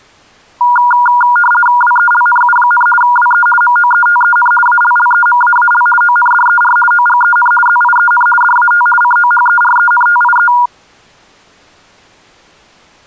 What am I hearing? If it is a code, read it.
RTTY (50 baud, 450 Hz shift), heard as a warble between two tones, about 1200 Hz centre. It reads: WELNU, WE MOETEN ALLEMAAL ONDER OGEN ZIEN DAT COHERENTIE